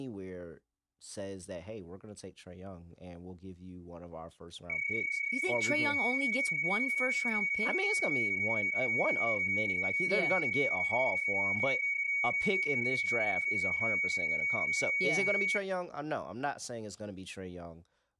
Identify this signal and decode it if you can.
PSK31 (31.25 baud), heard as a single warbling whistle, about 2250 Hz, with speech in English.